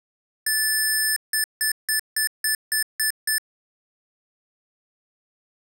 Beep code, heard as beeps from a small speaker, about 1750 Hz. 1 long, 8 short. In AMI BIOS tables: display or retrace test failure.